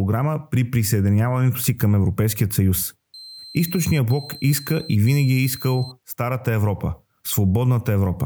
Beep code, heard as a piezo beeper, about 4100 Hz, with speech in Bulgarian. 3 long. In IBM BIOS tables: keyboard card error.